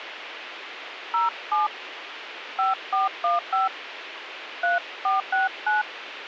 DTMF, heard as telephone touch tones, dialled by hand, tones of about 150 ms, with radio hiss. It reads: 07 5415 3469